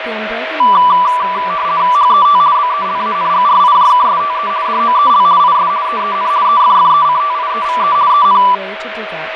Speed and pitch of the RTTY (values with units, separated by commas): 50 baud, 170 Hz shift, 1080 Hz centre